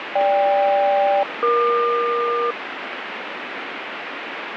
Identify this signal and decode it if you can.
Aircraft SELCAL, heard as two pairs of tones, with radio static. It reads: GK-EQ